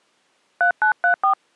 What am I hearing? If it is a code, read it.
DTMF, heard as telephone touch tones, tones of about 100 ms. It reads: 3934